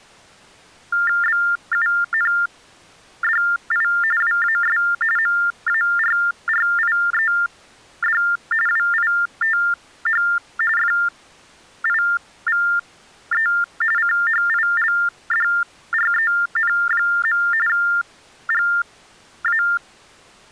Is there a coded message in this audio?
Yes: TTY/TDD text telephone tones (45.45 baud Baudot) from 0.9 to 19.8 s, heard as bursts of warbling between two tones, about 400 Hz shift, 1600 Hz centre. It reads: BUNDI WAS MARRIED WITH FIVE CHILDREN. GA